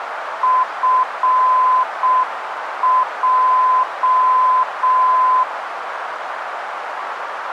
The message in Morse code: FJ

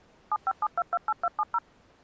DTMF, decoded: 757228270

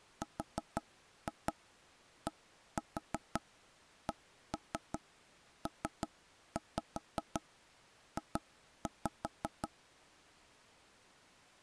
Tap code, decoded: RDCPJ

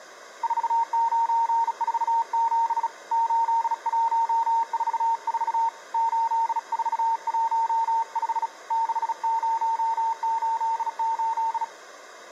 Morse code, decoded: 4947 8144 8415 6088

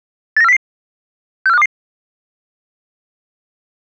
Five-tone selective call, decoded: 89400 64522

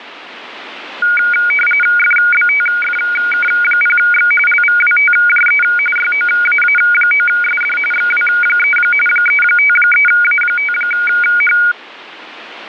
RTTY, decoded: FBTFK0X LVWTJE YOAA9SD XW3 353A5H

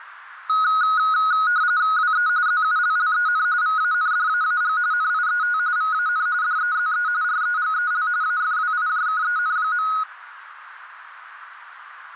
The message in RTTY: WE ZULLEN VANDAAG NIET VAN DEZE REGEL AFWIJKEN.

